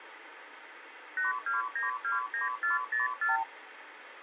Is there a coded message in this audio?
Yes: multi-frequency trunk signalling (R2, with the far end's replies) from 1.2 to 3.4 s, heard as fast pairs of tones, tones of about 150 ms, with phone line noise. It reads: 82929404